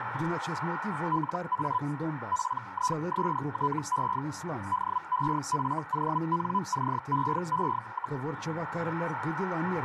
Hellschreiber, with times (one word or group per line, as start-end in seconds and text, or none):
1.1-1.8 LA
2.3-4.2 PISTE
4.7-8.2 DEFONCEE,